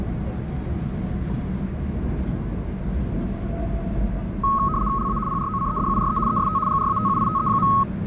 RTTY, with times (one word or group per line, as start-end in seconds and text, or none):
5.0-5.2 LA
5.3-6.2 PROCEDURE
6.3-6.6 EST
6.7-7.7 GRATUITE.